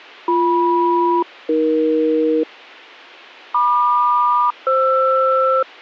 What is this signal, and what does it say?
Aircraft SELCAL, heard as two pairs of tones. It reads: BM-AE MQ-FR